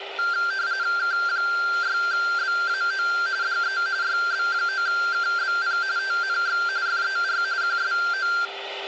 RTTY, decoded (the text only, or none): K6BAO DE YB9KBP TNX FER QSO